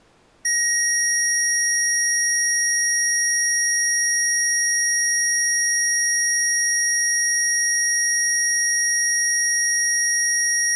A steady tone. There is no code.